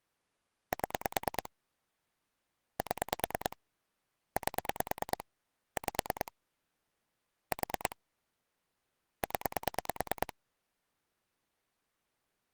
Pulse dialling, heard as clicks on a phone line, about 9 pulses a second. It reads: 7 7 8 5 4 0